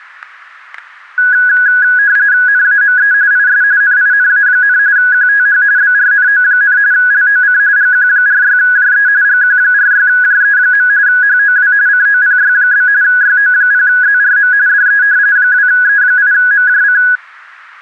RTTY (45.45 baud, 170 Hz shift), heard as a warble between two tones, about 1550 Hz centre, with static crashes. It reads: NAME IS NINA, QTH BRNO, LOC GQ46JE GQ46JE. HOW COPY? YO0ZRM DE 2E8MJC